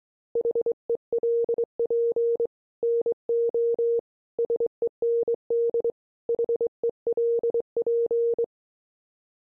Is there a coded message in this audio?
Yes: Morse code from 0.3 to 8.5 s, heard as a keyed tone, hand-sent with a straight key, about 23 wpm, 470 Hz. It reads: HELP NO SEND HELP